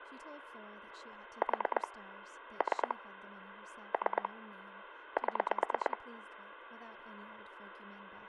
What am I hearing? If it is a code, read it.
Pulse dialling, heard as clicks on a phone line, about 9 pulses a second, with phone line noise and speech in English. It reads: 4 3 3 7